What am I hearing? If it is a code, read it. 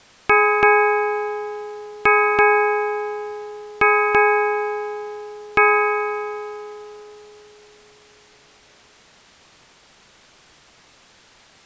Ship's bell, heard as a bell. 7. Seven half-hours of the watch have passed.